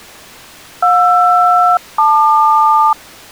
Aircraft SELCAL, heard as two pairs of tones. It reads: JR-LQ